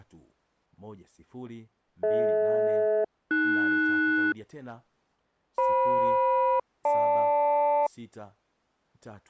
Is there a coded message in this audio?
Yes: aircraft SELCAL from 2.0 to 7.9 s, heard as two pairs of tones, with speech in Swahili. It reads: DH-AS FM-GL